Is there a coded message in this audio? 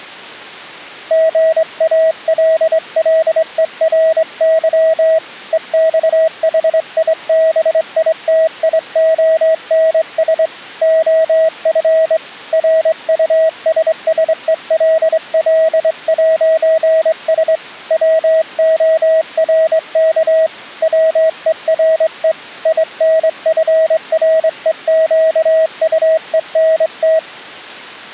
Yes: Morse code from 1.0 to 27.2 s, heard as a keyed tone, hand-sent with a straight key, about 23 wpm, 640 Hz. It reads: GALLERY EXHIBITIONS OF RUSSELL'S WORK WERE INFREQUENT